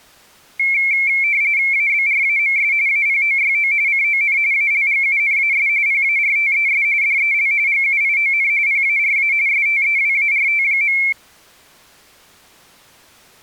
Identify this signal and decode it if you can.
RTTY (45.45 baud, 170 Hz shift), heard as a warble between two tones, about 2250 Hz centre. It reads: ABRAMS APOYO CON ALGUNAS PARTES DEL GUION PARA STEWART.